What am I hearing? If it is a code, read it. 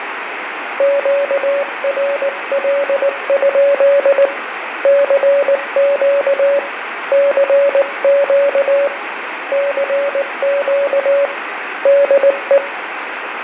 Morse code, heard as a keyed tone, hand-sent with a paddle, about 19 wpm, 560 Hz, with radio static, fading and room echo. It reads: QRL? CQ CQ CQ DE